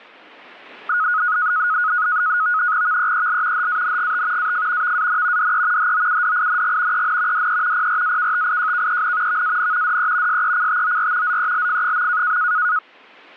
NAVTEX (SITOR-B), 100 baud, 170 Hz shift, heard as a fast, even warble, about 1360 Hz centre. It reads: VEEL HANGT AF VAN DE HOUDING EN DE PRAKTIJKEN VAN DE SECTOR ZELF.